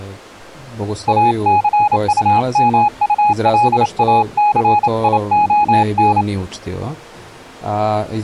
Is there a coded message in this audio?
Yes: Morse code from 1.0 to 6.3 s, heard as a keyed tone, hand-sent with a paddle, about 28 wpm, 830 Hz. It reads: ACUMULACION